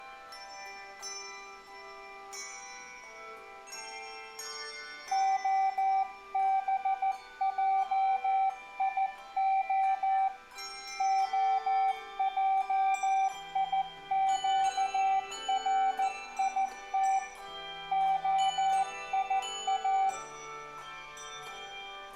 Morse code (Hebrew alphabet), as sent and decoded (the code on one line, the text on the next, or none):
--- -... .--- .. --- / --- .--- .. --.- .-. .. - / --- .. .-
הבעיה העיקרית היא